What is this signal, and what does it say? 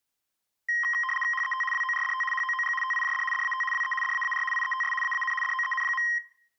RTTY (75 baud, 850 Hz shift), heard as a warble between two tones, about 1470 Hz centre, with room echo. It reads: HET WORDT HOOG TIJD DAT WE DAAR IETS AAN DOEN.